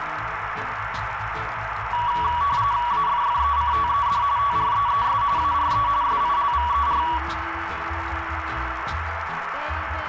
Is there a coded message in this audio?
Yes: RTTY (45.45 baud, 170 Hz shift) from 1.9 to 7.2 s, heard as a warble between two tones, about 1050 Hz centre, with radio static and a narrow filter. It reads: AFFECTED TREES ARE SILVER